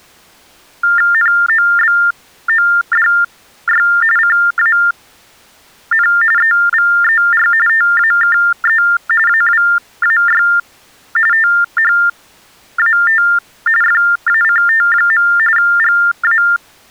TTY/TDD text telephone tones (45.45 baud Baudot), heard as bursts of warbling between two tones, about 400 Hz shift, 1600 Hz centre. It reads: NOBODY CAN EVER TAKE AWAY THAT FACT. GA